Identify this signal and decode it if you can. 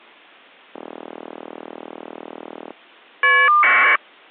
Caller ID data burst, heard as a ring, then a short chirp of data, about 1200 baud.